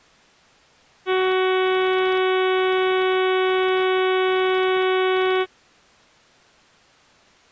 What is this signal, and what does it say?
Ship horn signal, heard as a ship's horn, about 370 Hz. 1 long. At sea: a vessel nearing a blind bend, or under power and making way in fog.